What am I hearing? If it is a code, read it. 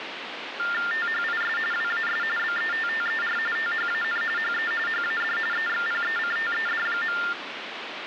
TTY/TDD text telephone tones (45.45 baud Baudot), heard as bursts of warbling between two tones, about 400 Hz shift, 1600 Hz centre, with phone line noise. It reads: THIS WAS BETTER THAN HE HAD EXPECTED.